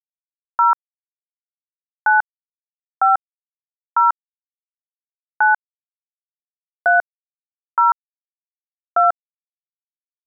DTMF, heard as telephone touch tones, dialled by hand, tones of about 140 ms. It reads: 0 9 5 0 9 3 0 2